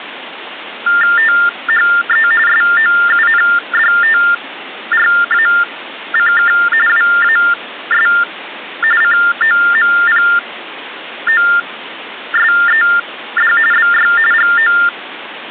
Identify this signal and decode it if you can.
TTY/TDD text telephone tones (45.45 baud Baudot), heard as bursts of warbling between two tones, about 400 Hz shift, 1600 Hz centre, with phone line noise. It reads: THE SOUNDTRACK WAS COMPOSED BY GO